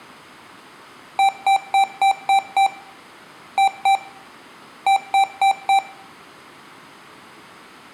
Beep code, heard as beeps from a small speaker, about 780 Hz, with room echo. 6-2-4.